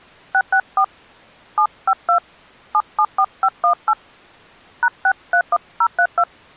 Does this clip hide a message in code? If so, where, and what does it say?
Yes: DTMF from 0.3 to 6.2 s, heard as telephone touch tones, dialled by hand, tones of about 70 ms. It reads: 664 752 774518 #631032